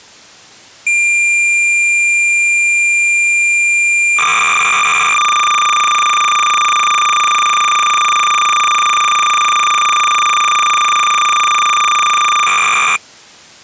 Cassette data (Kansas City type), 300 baud, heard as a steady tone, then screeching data.